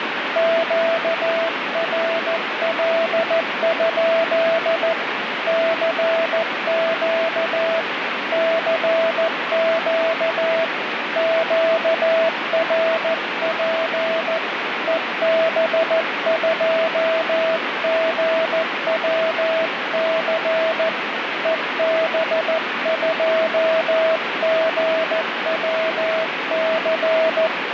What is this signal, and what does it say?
Morse code, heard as a keyed tone, hand-sent with a paddle, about 14 wpm, 650 Hz, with radio static. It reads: QRL? CQ CQ QRP EB2GWC EB2GWC